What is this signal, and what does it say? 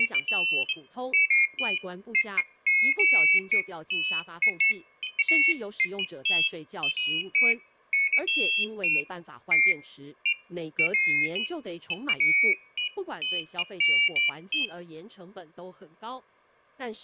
Pairs of high tones at irregular times, with speech in Chinese. There is no code.